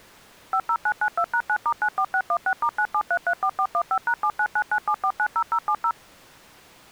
DTMF, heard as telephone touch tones, dialled by machine, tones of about 70 ms. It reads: 50992#9*94616*97334415#79997490070